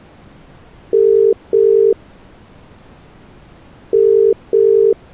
Telephone call progress tone (as in the UK, Ireland, Australia and similar networks), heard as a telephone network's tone, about 400, 450 Hz. Ringback tone.